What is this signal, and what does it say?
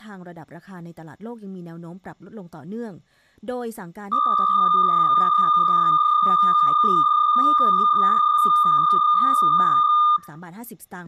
PSK63 (62.5 baud), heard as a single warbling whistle, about 1210 Hz, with room echo and speech in Thai.